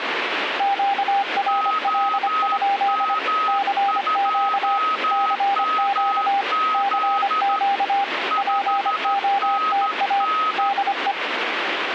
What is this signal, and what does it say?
Morse code, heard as two keyed tones, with radio static. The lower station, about 25 wpm, 800 Hz: QRL? CQ CQ CQ POTA DE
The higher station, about 13 wpm, 1270 Hz: OM2MZ 5NN